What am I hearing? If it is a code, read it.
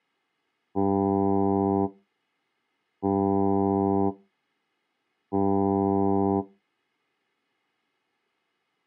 Ship horn signal, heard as a ship's horn, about 100 Hz. 3 short. At sea: I am operating astern propulsion.